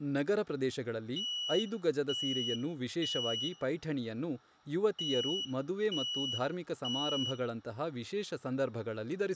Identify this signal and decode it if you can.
Alarm pattern, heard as an alarm's beeps, played twice, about 2950 Hz, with room echo and speech in Kannada. Temporal three. Smoke or fire, evacuate.